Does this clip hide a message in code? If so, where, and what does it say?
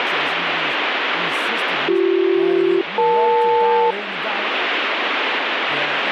Yes: aircraft SELCAL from 1.9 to 3.9 s, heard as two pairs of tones, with radio static and speech in English. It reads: BC-EL